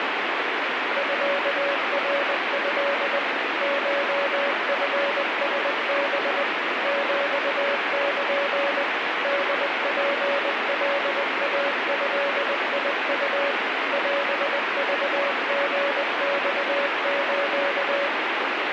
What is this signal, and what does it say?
Morse code (Japanese Wabun code), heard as a keyed tone, machine-sent, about 20 wpm, 560 Hz, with heavy radio static. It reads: ミナト コチラハ ヒル ホツカイドウ オクリマス